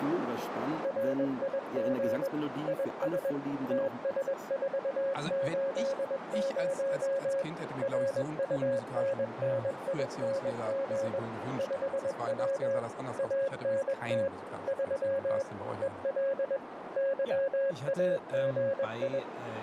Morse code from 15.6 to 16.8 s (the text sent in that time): EL